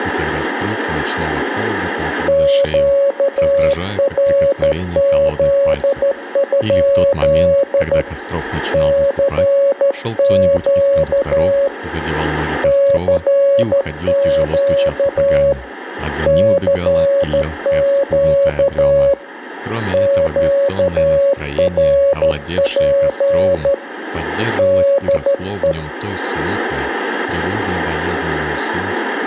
Morse code, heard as a keyed tone, hand-sent with a straight key, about 13 wpm, 560 Hz, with room echo. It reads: QRZ? CQ CQ CQ QRP DE